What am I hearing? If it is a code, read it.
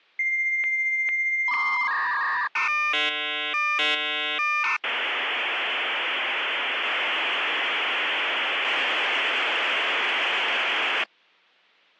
Dial-up modem handshake (V.34 or later), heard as a whistle, warbles, then hiss.